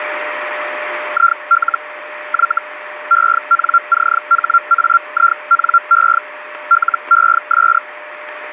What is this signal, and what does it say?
Hellschreiber (Feld-Hell, 122.5 baud), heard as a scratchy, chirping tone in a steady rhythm, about 1380 Hz, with radio static and a steady whistle near 600 Hz. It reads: IL Y ENCHAINE LES